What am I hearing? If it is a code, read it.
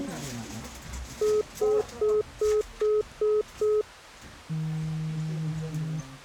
Telephone call progress tone (single-tone plan, as in most of Europe), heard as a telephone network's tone, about 420 Hz, 0.2 s on and 0.2 s off, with the noise inside a lift. Congestion tone.